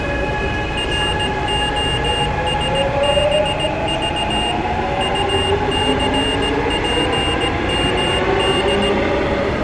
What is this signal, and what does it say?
Morse code, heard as a high beeper, machine-sent, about 17 wpm, 2800 Hz, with the noise inside a subway train. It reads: ROSBV UCPMD